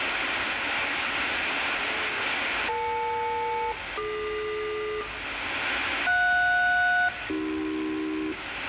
Aircraft SELCAL, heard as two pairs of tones, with radio static, room echo and the noise of a residential street. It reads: EL-DQ JS-AC